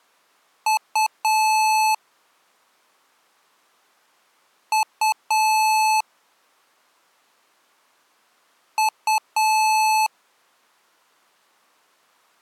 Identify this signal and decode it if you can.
Beep code, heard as beeps from a small speaker, played three times, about 870 Hz. 2 short, 1 long.